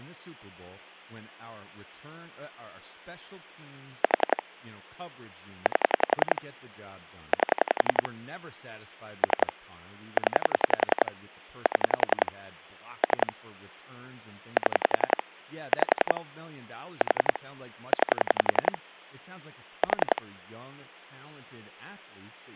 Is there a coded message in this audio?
Yes: pulse dialling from 4.0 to 20.2 s, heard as clicks on a phone line, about 11 pulses a second, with speech in English. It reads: 4 8 8 3 0 7 3 7 5 4 9 4